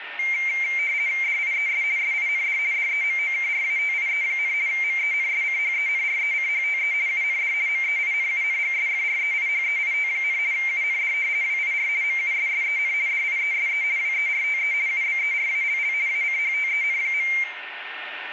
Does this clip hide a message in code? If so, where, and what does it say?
Yes: RTTY (50 baud, 170 Hz shift) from 0.2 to 17.4 s, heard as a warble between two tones, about 2200 Hz centre, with radio static, a steady whistle near 1820 Hz and room echo. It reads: DIES SIND DEMOKRATIE, MENSCHENRECHTE UND MEINUNGSFREIHEIT, UND WIR MUSSEN DIESE WERTE UBERALL ACHTEN.